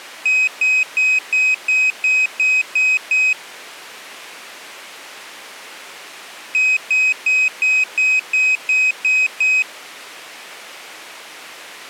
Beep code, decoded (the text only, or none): 9 short